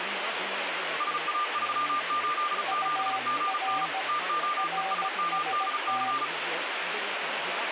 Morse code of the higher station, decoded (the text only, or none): SA387GN TOESMDC